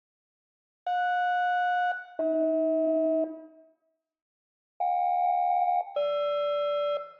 Aircraft SELCAL, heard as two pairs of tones, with room echo. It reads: JS-AH JK-GR